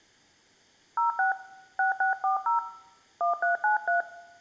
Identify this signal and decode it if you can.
DTMF, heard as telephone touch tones, dialled by hand, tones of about 130 ms, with room echo. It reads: 06 6640 1393